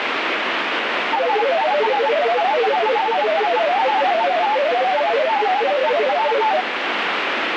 Multi-tone FSK (Olivia or MFSK type), about 500 Hz wide, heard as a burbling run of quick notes, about 31.25 baud, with radio static.